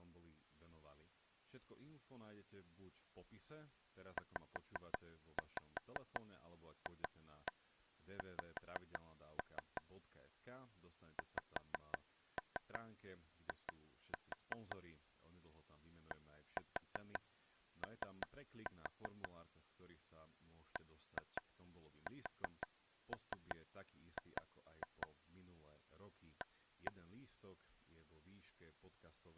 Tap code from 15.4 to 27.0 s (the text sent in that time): DO BSG A